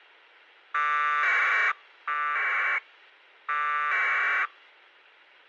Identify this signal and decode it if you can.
Packet radio (AX.25, as in APRS), 1200 baud, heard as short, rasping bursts.